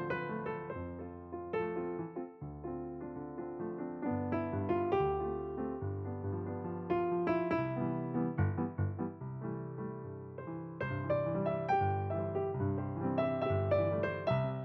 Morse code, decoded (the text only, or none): none